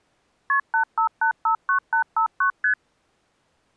Multi-frequency trunk signalling (R1, as on North American trunks), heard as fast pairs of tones, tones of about 100 ms. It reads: KP 85859859 ST